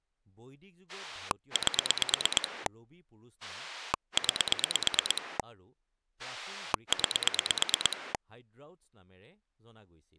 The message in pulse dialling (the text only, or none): 8 9 9